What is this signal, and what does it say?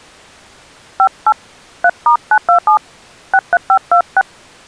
DTMF, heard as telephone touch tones, dialled by hand, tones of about 70 ms. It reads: 58 3*927 63526